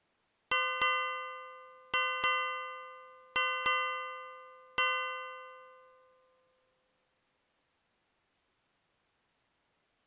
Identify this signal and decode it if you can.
Ship's bell, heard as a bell. 7. Seven half-hours of the watch have passed.